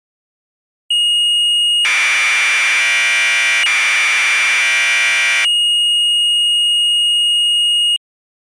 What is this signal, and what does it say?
Commodore tape loading (standard loader), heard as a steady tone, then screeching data.